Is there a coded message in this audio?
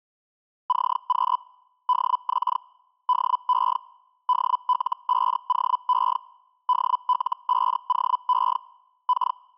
Yes: Hellschreiber (Feld-Hell, 122.5 baud) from 0.7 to 9.4 s, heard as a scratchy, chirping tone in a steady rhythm, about 1000 Hz. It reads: CQ DX DE DL5OE DL5OE K